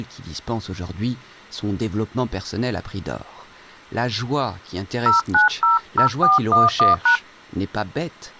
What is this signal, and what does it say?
DTMF, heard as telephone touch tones, dialled by hand, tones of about 140 ms, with speech in French. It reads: 0900411#